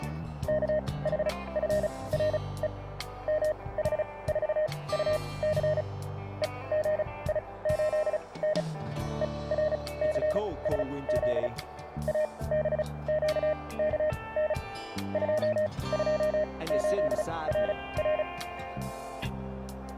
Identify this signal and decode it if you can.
Morse code, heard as a keyed tone, machine-sent, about 35 wpm, spaced as for 22 wpm, 610 Hz, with radio static. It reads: KHFRE MH4UC EGI8N ERCSZ ABQKN 228RR